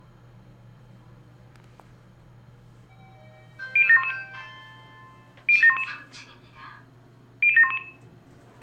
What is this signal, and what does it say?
Five-tone selective call (ZVEI), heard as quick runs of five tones, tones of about 70 ms, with room echo and the noise inside a lift. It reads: 00711 00711 00711